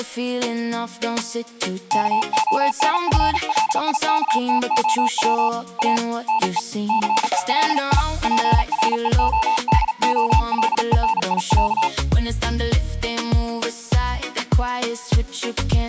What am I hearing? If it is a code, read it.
Morse code (Russian alphabet), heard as a keyed tone, hand-sent with a paddle, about 38 wpm, 890 Hz. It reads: КОНФЛИКТОВ А НЕ ЦЕЛИ ПРЕОДОЛЕНИЯ